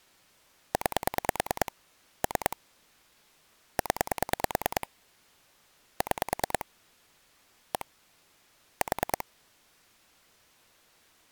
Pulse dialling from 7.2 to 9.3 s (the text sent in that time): 1 4